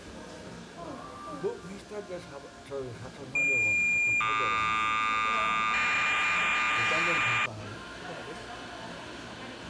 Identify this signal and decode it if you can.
Cassette data (Kansas City type), 1200 baud, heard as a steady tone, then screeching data, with the noise of a cafe.